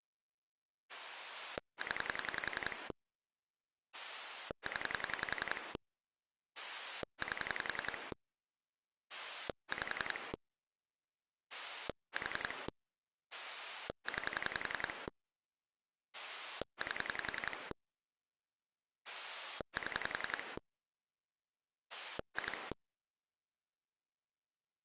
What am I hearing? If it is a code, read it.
Pulse dialling, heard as a rotary dial, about 11 pulses a second. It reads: 0 0 8 5 4 9 8 7 2